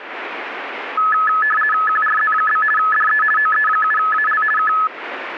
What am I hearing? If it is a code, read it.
RTTY (50 baud, 450 Hz shift), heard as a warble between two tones, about 1500 Hz centre, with radio static. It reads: QRZ? DE OE7AL K